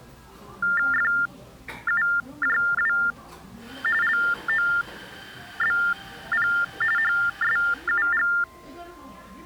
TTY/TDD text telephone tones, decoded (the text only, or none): FUJW LOBP HSUG